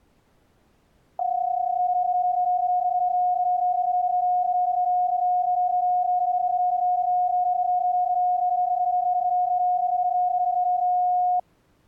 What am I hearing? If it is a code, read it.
PSK31 (31.25 baud), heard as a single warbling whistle, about 720 Hz.